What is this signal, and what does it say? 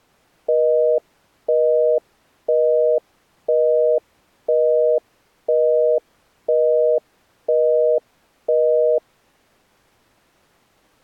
Telephone call progress tone (North American plan), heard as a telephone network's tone, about 480, 620 Hz, 0.5 s on and 0.5 s off. Busy tone.